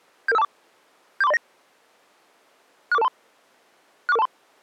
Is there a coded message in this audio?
Yes: five-tone selective call (EIA) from 0.3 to 4.3 s, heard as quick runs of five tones, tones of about 30 ms. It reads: 77524 74309 64423 64423